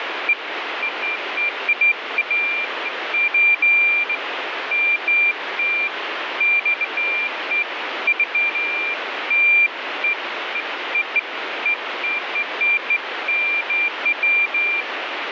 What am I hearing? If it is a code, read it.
Beeps of irregular length, with radio static. There is no code.